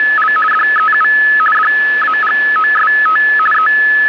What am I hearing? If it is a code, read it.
RTTY (50 baud, 450 Hz shift), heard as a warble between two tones, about 1500 Hz centre, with radio static. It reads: … DEU DAGOST …